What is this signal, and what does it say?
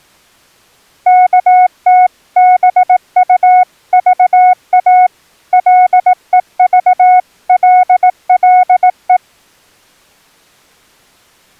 Morse code (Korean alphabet), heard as a keyed tone, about 18 wpm, 730 Hz. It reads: 어디로 갈까